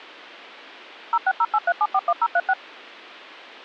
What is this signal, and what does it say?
DTMF, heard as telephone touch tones, dialled by machine, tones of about 50 ms. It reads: 06083741036